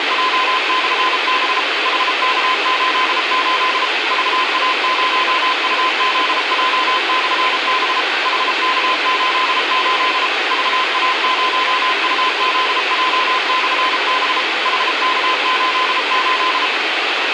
Morse code, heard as a keyed tone, machine-sent, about 33 wpm, 1020 Hz, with radio hiss and a squelch burst at the end. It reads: … HK88 VA0UZJ/B HK88 VA0UZJ/B HK88